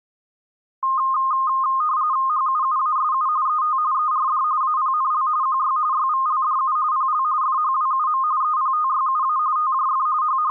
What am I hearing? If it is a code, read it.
RTTY (45.45 baud, 170 Hz shift), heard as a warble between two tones, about 1150 Hz centre. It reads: HUUASU ET ERD APNL QY YVLDU PL FHWUM EPTYUA TJF …